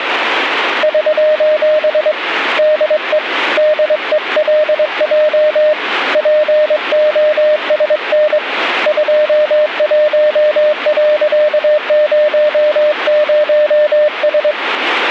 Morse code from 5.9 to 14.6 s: POSN 21.00S

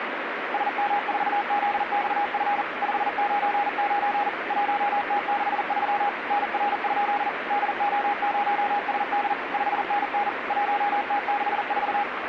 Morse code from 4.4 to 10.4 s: 1T63 NR? DO0SD 5NN

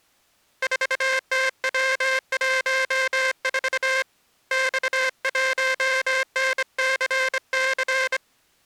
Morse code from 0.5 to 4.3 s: 4TW14

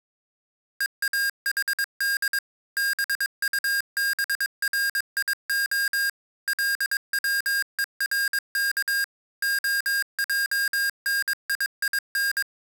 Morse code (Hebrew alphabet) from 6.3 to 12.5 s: לצורך העניין

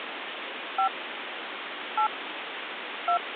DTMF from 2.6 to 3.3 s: 2

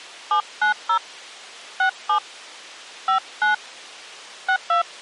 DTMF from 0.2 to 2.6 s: 790 67

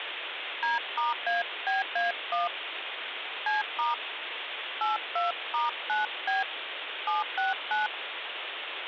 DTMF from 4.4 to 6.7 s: 82*9B

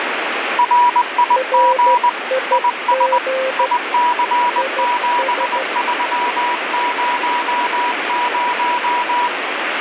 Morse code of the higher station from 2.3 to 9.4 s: IS IC7300

